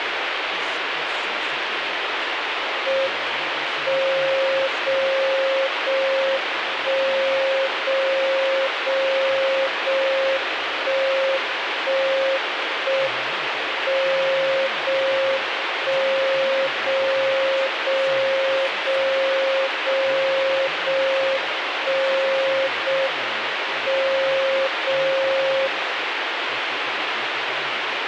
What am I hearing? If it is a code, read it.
Radio time signal (JJY), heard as a tone whose level steps once a second, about 540 Hz, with radio static. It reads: M 0 0 1 0 0 0 1 1 1 M 0 1 0 0 0 0 0 1 0 M 0 0